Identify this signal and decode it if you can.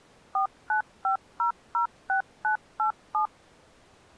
DTMF, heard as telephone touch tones, dialled by machine, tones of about 110 ms. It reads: 495006987